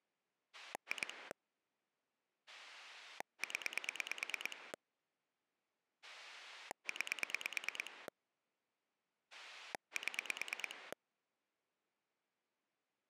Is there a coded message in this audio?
Yes: pulse dialling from 0.5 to 10.9 s, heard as a rotary dial, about 9 pulses a second. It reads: 2 0 9 7